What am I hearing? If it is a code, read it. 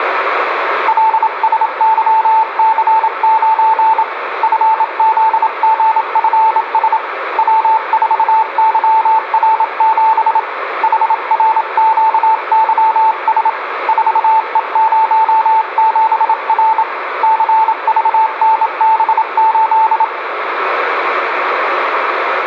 Morse code, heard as a keyed tone, hand-sent with a bug key, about 27 wpm, 880 Hz, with radio static and room echo. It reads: LSYC9 FZGFS W4YR7 HRQYS 4E07R CVNB8